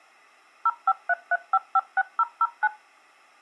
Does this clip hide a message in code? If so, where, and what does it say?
Yes: DTMF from 0.7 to 2.7 s, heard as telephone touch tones, dialled by machine, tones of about 40 ms. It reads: 0533556009